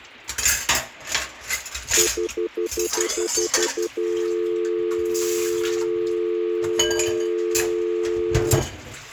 Telephone call progress tone (North American plan), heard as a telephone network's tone, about 350, 440 Hz, 0.1 s on and 0.1 s off, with kitchen noise. Stutter dial tone.